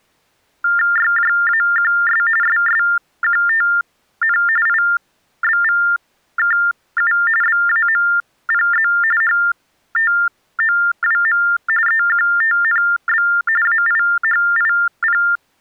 TTY/TDD text telephone tones (45.45 baud Baudot), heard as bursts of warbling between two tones, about 400 Hz shift, 1600 Hz centre. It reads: YJAQS SSQTN IBVKU BAMPZ HTOWM EQTNB AIHIP